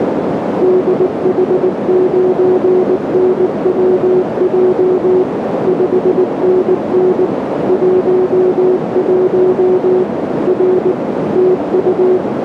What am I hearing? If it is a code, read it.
Morse code, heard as a keyed tone, machine-sent, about 19 wpm, 370 Hz, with heavy radio static and a narrow filter. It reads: DH9NWJ 5NN 11 R TU